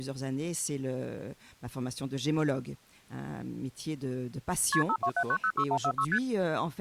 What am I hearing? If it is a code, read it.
Multi-frequency trunk signalling (R1, as on North American trunks), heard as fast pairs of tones, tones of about 70 ms. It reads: KP 527906146 ST